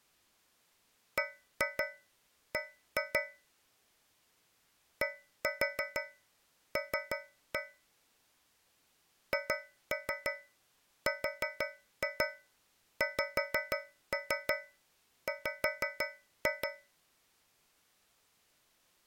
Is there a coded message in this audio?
Yes: tap code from 1.2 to 17.0 s, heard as taps on a metal pipe, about 6 knocks a second. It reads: BB DL HRXW